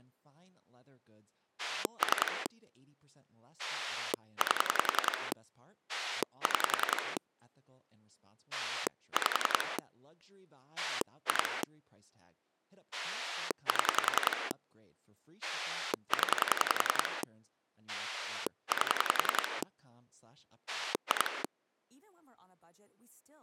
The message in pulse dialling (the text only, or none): 3 8 6 5 2 7 0 8 2